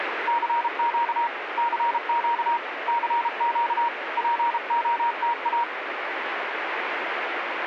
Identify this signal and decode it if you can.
Morse code, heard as a keyed tone, hand-sent with a paddle, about 33 wpm, 940 Hz, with radio static. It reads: CQ CQ CQ POTA